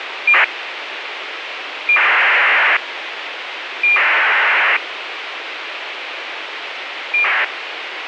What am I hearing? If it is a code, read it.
ACARS aircraft data, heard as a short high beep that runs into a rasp, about 2400 baud, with radio hiss and a squelch burst at the end.